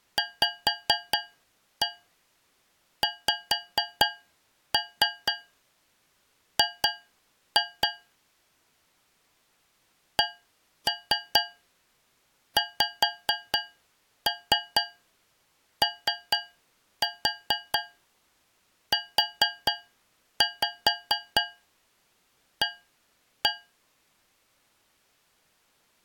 Tap code, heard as taps on a metal pipe, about 4 knocks a second. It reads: VXG CXOUA